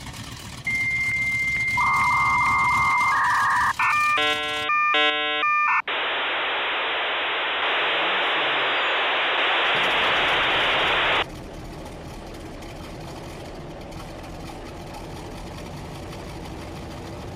Dial-up modem handshake (V.34 or later), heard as a whistle, warbles, then hiss.